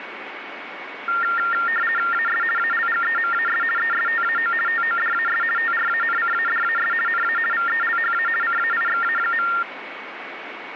RTTY (50 baud, 450 Hz shift), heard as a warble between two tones, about 1600 Hz centre, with radio static and a steady whistle near 2230 Hz. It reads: AS ALGEMAS ESTAO TODAS TRANCADAS NA VELHA CAIXA.